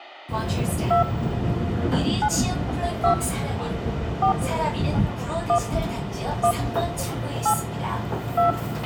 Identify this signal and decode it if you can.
DTMF, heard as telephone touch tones, dialled by hand, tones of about 100 ms, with a squelch burst at the end and the noise of a subway station. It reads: 2 9 2 4 1 1 8 2